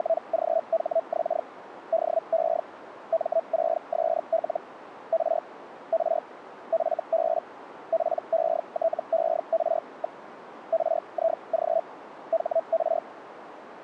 Hellschreiber (Feld-Hell, 122.5 baud), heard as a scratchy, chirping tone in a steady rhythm, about 660 Hz, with radio static. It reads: … DE M6SL R R FB PETER. RIG HR